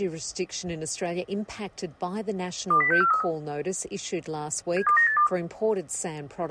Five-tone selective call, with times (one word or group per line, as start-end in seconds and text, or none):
2.7-3.2 20643
4.8-5.3 72982